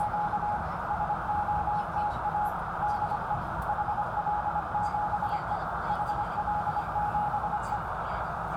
Morse code, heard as a keyed tone, machine-sent, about 25 wpm, 840 Hz, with heavy radio static, a narrow filter and the noise inside a subway train. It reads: … SOTA DE HL7E HL7E